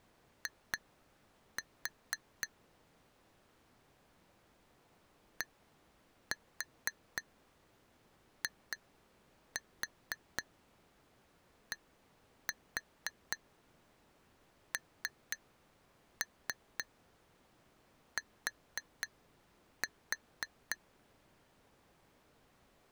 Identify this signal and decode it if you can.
Tap code, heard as taps on glass, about 4 knocks a second. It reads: I DIDNT